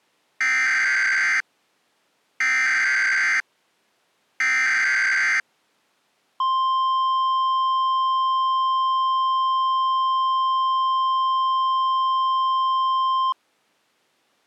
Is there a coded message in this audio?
Yes: Emergency Alert System (SAME) tones (header bursts, then the 1050 Hz attention tone) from 0.4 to 13.3 s, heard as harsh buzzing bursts, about 520.83 baud.